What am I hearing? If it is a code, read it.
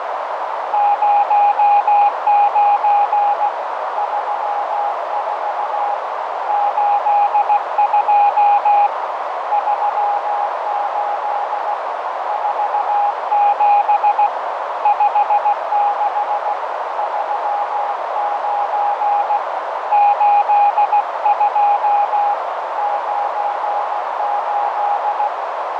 Morse code, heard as a keyed tone, hand-sent with a paddle, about 16 wpm, 820 Hz, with heavy radio static, fading and a narrow filter. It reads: 09 34 82 38 47 56 39 82 98